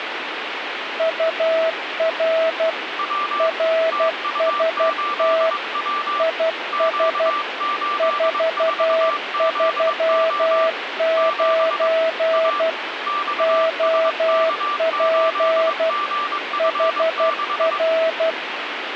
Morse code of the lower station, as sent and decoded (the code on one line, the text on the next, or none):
..- .-. / .-. ... - / .. ... / ....- ...-- ----. / --- .--. / .... .-.
UR RST IS 439 OP HR